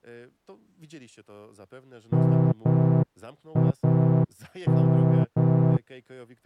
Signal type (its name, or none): Morse code